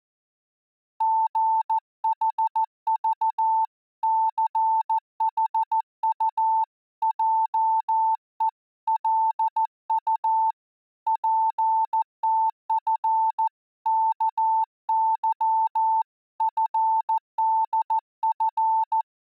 Morse code (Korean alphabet), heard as a keyed tone, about 14 wpm, 890 Hz. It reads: 술취하기 전에는